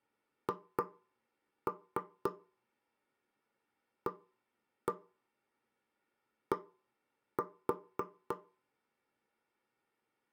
Tap code, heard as knocks on wood, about 3 knocks a second. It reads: HAD